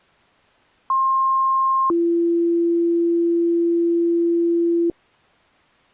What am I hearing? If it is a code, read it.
Two-tone page, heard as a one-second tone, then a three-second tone, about 1060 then 340 Hz.